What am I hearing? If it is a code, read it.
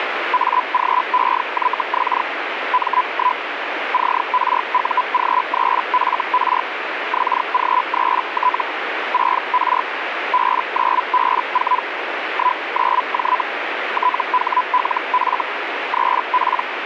Hellschreiber (Feld-Hell, 122.5 baud), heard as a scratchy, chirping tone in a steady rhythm, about 1000 Hz, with radio static. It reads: AGEYX M1 CRUG3FR XG3T 6R B9B4 19J THLF 3P